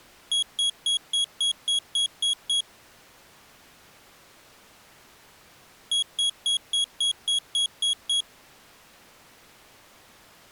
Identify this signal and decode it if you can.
Beep code, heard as a piezo beeper, played twice, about 3300 Hz. 9 short. In AMI BIOS tables: ROM checksum failure.